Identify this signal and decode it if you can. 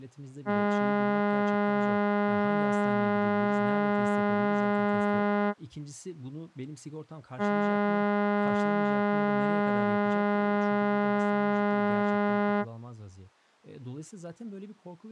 Ship horn signal, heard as a ship's horn, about 200 Hz, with speech in Turkish. 2 long. At sea: a vessel under power that has stopped in fog.